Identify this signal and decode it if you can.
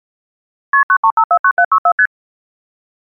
Multi-frequency trunk signalling (R1, as on North American trunks), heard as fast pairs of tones, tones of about 70 ms. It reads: KP 93549764 ST